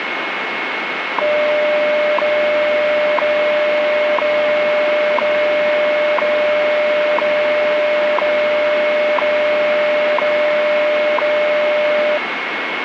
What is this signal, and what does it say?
Radio time signal (WWV, Colorado), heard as ticks, one a second, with radio static and a steady whistle near 2180 Hz.